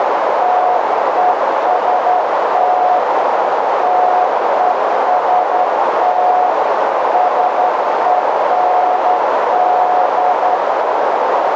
Morse code, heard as a keyed tone, hand-sent with a straight key, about 11 wpm, 730 Hz, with heavy radio static and a narrow filter. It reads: TEST TEST SEND